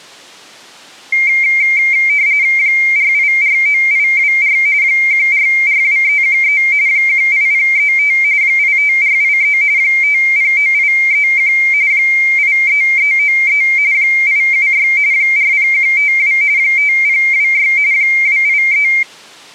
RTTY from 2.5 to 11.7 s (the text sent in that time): 4849824 1442313 18035 85483 509831